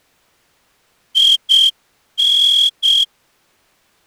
Morse code, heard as a whistle, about 7 wpm. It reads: IN